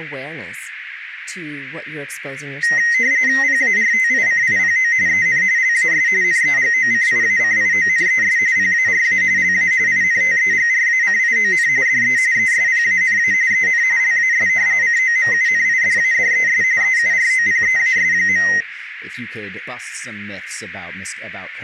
RTTY (45.45 baud, 170 Hz shift), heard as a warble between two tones, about 1950 Hz centre, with radio static and speech in English. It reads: PARTICIPO EN LAS NEGOCIACIONES PARA LA INTEGRACION DE ESPANA EN LAS COMUNIDADES EUROPEAS.